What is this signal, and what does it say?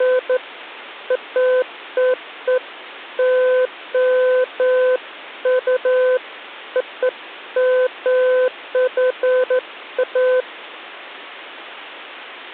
Beeps of irregular length. There is no code.